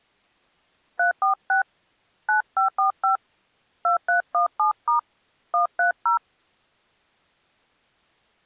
DTMF, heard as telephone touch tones, dialled by hand, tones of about 120 ms. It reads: 346 9545 2317* 130